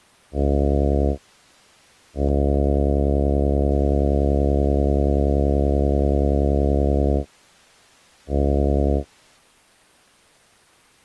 Ship horn signal, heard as a ship's horn, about 70 Hz. 1 short, 1 long, 1 short. At sea: a vessel at anchor warns of its position.